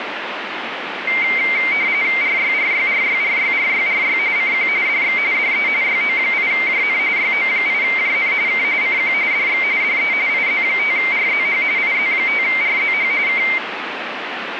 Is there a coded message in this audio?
Yes: RTTY (45.45 baud, 170 Hz shift) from 1.1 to 13.6 s, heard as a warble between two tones, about 2200 Hz centre, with radio static. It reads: RYRYRYRYRYRY CQ DX DE YO8JN YO8JN K CQ DX DE IZ5RZH IZ5RZH K